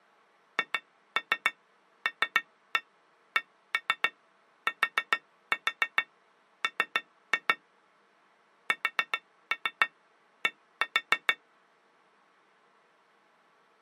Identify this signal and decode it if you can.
Tap code, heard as taps on glass, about 7 knocks a second. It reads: HLCTM SD